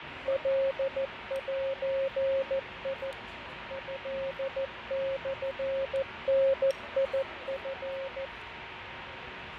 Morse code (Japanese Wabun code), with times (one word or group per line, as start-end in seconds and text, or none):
0.3-3.1 カゼ
3.7-8.2 トモダチ